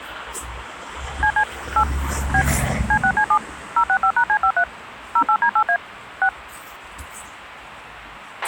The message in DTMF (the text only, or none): CC 8 B C6C7 065#C53 08D8A 6